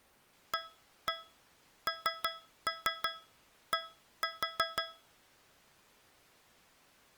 Tap code, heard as taps on a metal pipe, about 5 knocks a second. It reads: AND